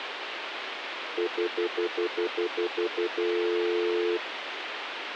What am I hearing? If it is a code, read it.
Telephone call progress tone (North American plan), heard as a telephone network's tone, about 350, 440 Hz, 0.1 s on and 0.1 s off, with phone line noise. Stutter dial tone.